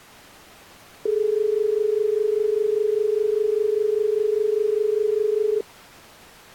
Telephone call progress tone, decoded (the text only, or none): dial tone